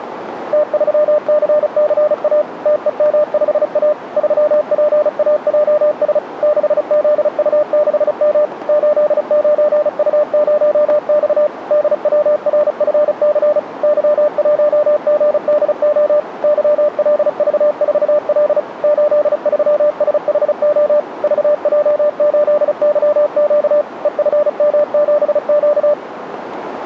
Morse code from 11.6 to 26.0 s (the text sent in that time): DWRFC Y1GDO YLV4L 83SHO VJ8YQ EFM7Q